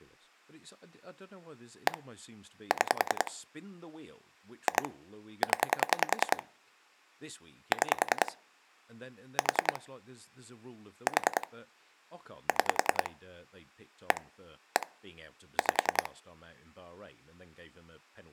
Pulse dialling, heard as clicks on a phone line, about 10 pulses a second, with speech in English. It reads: 1 6 2 0 6 4 4 6 1 1 5